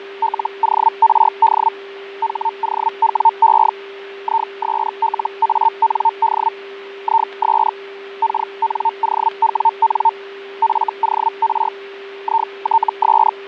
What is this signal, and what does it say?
Hellschreiber (Feld-Hell, 122.5 baud), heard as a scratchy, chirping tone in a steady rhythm, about 900 Hz, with fading and a steady whistle near 400 Hz. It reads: LORD HOWE ISLAND IS KNOWN FOR ITS